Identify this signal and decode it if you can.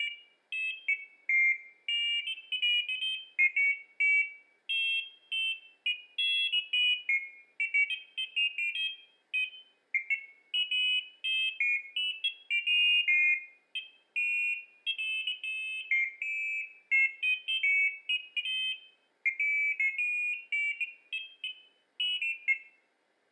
Pairs of high tones at irregular times, with room echo. There is no code.